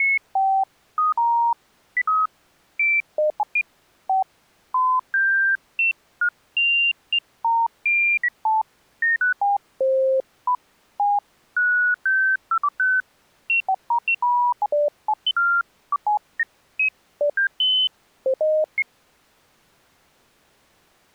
Electronic bleeps of random pitch and length. There is no code.